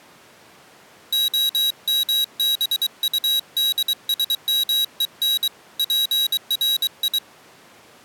Morse code (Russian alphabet), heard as a high beeper, hand-sent with a paddle, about 23 wpm, 3850 Hz. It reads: ОМБУДСМЕН ПРИ